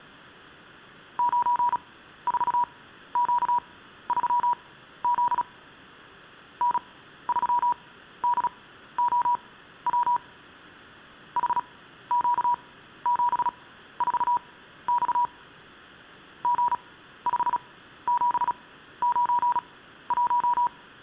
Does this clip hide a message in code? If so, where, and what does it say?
Yes: Morse code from 1.1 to 20.7 s, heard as a keyed tone, machine-sent, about 36 wpm, spaced as for 14 wpm, 970 Hz. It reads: 94Q3Z N3DOW HQ74X G5791